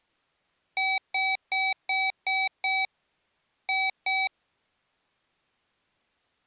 Beep code, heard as beeps from a small speaker, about 760 Hz. 6-2.